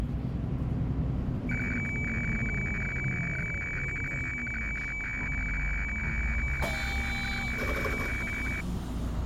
Weather fax (radiofax), 120 lines a minute, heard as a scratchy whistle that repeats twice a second, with the noise inside a bus.